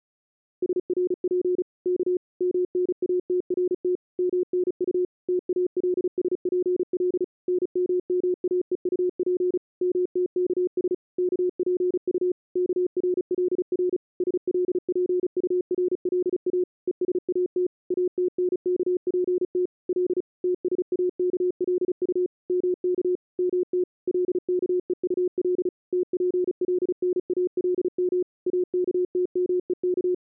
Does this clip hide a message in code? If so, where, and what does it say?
Yes: Morse code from 0.6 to 30.2 s, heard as a keyed tone, machine-sent, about 35 wpm, 360 Hz. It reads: SRP K MNATRT MNU TALSPL NMMAEUP MTKS KPU KRLR SLPURLA ESAT ATNKPT L TSAKLU MK MT LKEUL TPLNALM AKTMEK